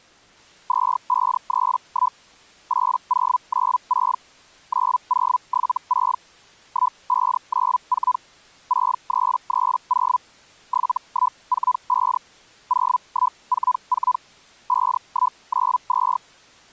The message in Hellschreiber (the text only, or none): 2531 8096 9076 1594 6330 7145 0144 5192